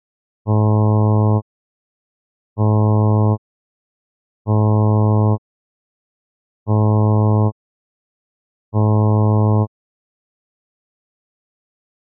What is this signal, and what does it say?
Ship horn signal, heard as a ship's horn, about 110 Hz. 5 short. At sea: I doubt that you are doing enough to avoid a collision.